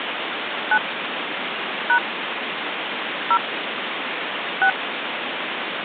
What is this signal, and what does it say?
DTMF, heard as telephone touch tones, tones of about 70 ms, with phone line noise. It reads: 9 # 0 6